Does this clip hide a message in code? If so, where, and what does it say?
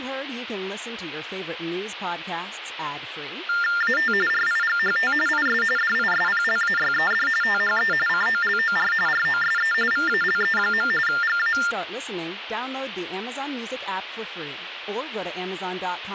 Yes: TTY/TDD text telephone tones (45.45 baud Baudot) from 3.5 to 11.7 s, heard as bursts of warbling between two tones, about 400 Hz shift, 1600 Hz centre, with phone line noise and speech in English. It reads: AT RIGHT IS DISPLAYED THE COLOR ROSE VALE. GA